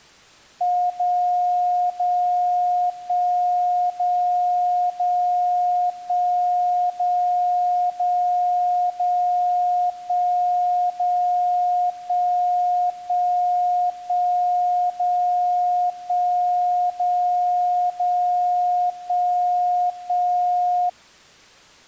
Radio time signal (DCF77), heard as a tone whose level steps once a second, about 720 Hz. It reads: 0 0 1 0 0 1 0 0 0 1 0 1 1 1 0 1 0 0 1 1